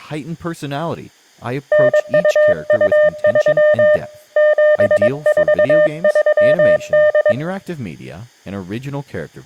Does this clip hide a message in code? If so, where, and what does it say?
Yes: Morse code (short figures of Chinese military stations) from 1.7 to 7.4 s, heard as a keyed tone, hand-sent with a paddle, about 22 wpm, 600 Hz. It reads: 9223 7438